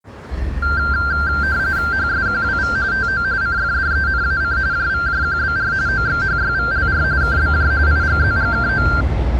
RTTY (45.45 baud, 170 Hz shift), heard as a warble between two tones, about 1480 Hz centre, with the noise of a residential street. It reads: HSQWV TO CFDENAC JVJQBR OXHYVLR KBJ IGZGKO